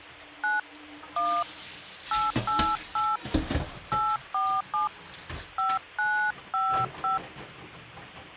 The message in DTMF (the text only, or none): 9 1 888 847 5955